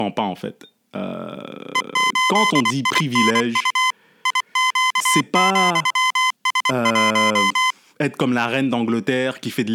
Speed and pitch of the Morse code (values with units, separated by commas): 24 wpm, 1020 Hz